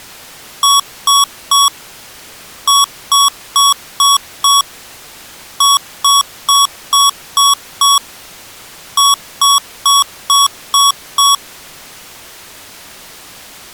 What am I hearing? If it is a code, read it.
Beep code, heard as beeps from a small speaker, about 1120 Hz. 3-5-6-6.